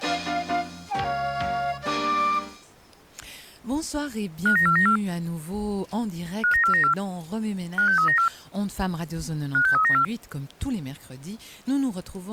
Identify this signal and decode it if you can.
Five-tone selective call (CCIR), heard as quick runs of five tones, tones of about 100 ms. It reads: 59494 59494 56394 56394